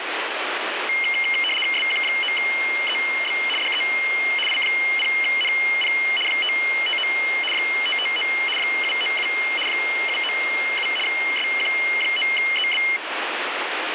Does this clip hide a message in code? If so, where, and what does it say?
Yes: RTTY (75 baud, 850 Hz shift) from 0.9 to 13.0 s, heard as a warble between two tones, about 2550 Hz centre, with radio static. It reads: SQ9EB DE I0NP 559 559 797 797 SQ9EB